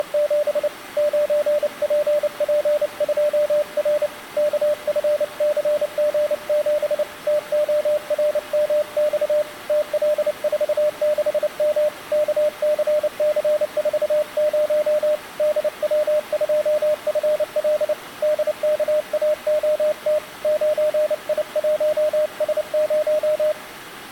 Morse code, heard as a keyed tone, hand-sent with a paddle, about 29 wpm, 600 Hz. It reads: … 9PP2R KFCG7 TORMX TL46M KCC40 DW2FL DKAOT 9I1S0